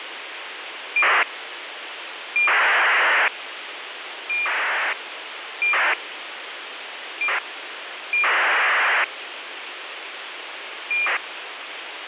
ACARS aircraft data, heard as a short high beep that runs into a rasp, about 2400 baud, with radio hiss.